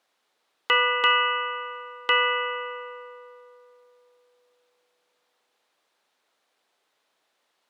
Ship's bell, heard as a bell. 3. Three half-hours of the watch have passed.